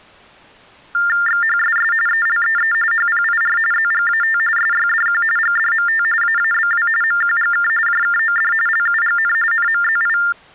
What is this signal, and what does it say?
TTY/TDD text telephone tones (45.45 baud Baudot), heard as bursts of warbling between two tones, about 400 Hz shift, 1600 Hz centre. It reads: XHSS ELEE HPIR ZGAT SYDQ GDMT AABW MQGK JKOD LUGN NMZI